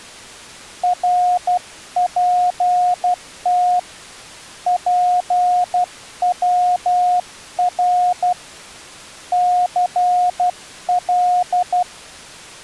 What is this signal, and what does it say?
Morse code, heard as a keyed tone, hand-sent with a paddle, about 12 wpm, 720 Hz. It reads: RPT PWR CL